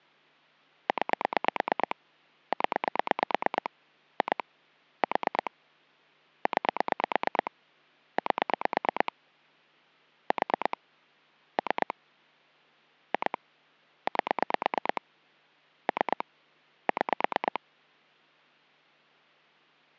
Pulse dialling, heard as clicks on a phone line, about 8 pulses a second. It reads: 9 0 2 4 9 8 4 3 2 8 3 6